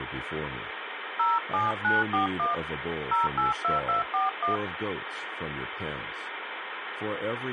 DTMF, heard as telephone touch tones, dialled by hand, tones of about 150 ms, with phone line noise. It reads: 07941 082241